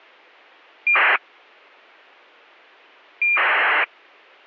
ACARS aircraft data, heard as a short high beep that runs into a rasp, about 2400 baud.